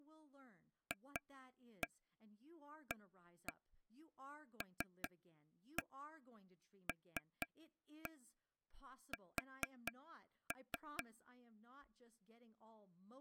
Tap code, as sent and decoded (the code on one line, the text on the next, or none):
2-1 1-1 3-1 3-1 4-3
FALLS